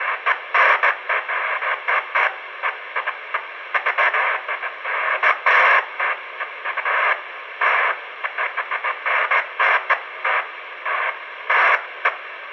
Bursts of noise, with radio static, fading and room echo. There is no code.